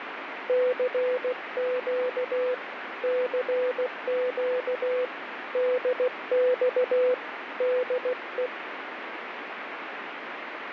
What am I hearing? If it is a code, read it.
Morse code, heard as a keyed tone, hand-sent with a paddle, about 16 wpm, 500 Hz, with radio static. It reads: CQ CQ DX DE